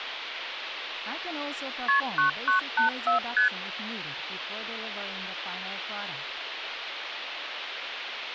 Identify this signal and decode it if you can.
Multi-frequency trunk signalling (R1, as on North American trunks), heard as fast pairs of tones, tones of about 120 ms, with phone line noise. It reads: KP 9984 ST